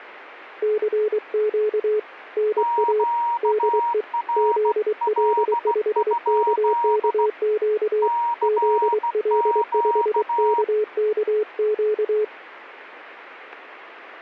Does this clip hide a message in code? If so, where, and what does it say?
Yes: Morse code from 0.6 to 12.3 s, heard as two keyed tones. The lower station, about 23 wpm, 430 Hz: CQ NA DE ZL5KKQ ZL5KKQ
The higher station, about 16 wpm, 940 Hz: QRL? CQ